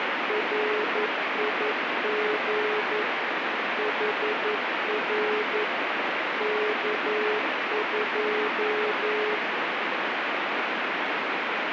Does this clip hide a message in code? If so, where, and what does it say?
Yes: Morse code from 0.2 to 9.4 s, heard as a keyed tone, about 11 wpm, 420 Hz, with heavy radio static. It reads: RIG HR K2